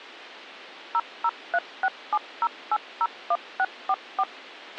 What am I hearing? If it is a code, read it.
DTMF, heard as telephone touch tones, dialled by machine, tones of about 50 ms, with a squelch burst at the end. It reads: 003670801644